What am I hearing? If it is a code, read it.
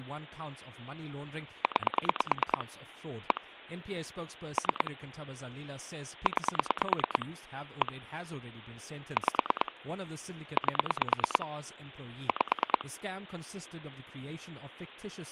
Pulse dialling, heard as clicks on a phone line, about 9 pulses a second, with speech in English. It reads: 9 1 3 9 1 5 8 5